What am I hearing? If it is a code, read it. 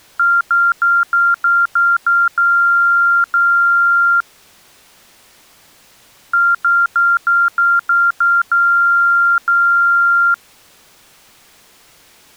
Beep code, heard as beeps, played twice, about 1390 Hz. 7 short, 2 long.